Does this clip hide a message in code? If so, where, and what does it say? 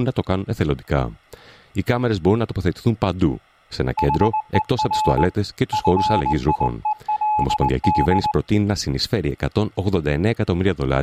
Yes: Morse code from 3.9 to 8.4 s, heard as a keyed tone, hand-sent with a straight key, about 19 wpm, 860 Hz. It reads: HER FIELD